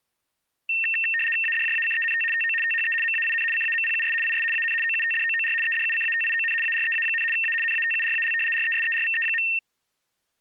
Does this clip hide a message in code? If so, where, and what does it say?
Yes: RTTY (75 baud, 850 Hz shift) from 0.7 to 9.6 s, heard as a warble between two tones, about 2250 Hz centre. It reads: ADJACENT TO THE MAIN CAMPUS IS AN OUTDOOR EDUCATION AREA, A NATURAL RESERVE.